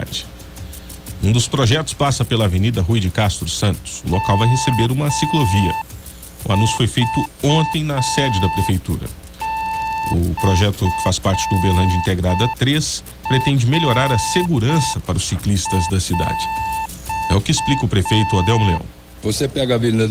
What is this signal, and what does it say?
Morse code (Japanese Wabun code), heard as a keyed tone, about 5 wpm, 890 Hz. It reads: ヨクモナヰ